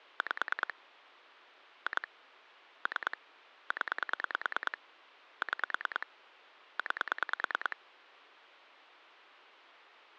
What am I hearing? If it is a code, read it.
Pulse dialling, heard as clicks on a phone line, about 9 pulses a second, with phone line noise. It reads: 5 2 3 0 6 9